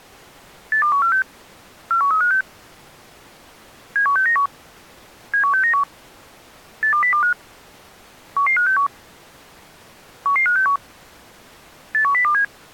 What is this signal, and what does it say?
Five-tone selective call (CCIR), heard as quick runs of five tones, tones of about 100 ms. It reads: 82146 41356 71691 71691 82025 11561 11561 81027